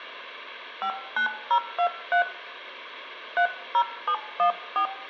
DTMF, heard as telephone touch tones, dialled by hand, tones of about 90 ms, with room echo. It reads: 59023 30714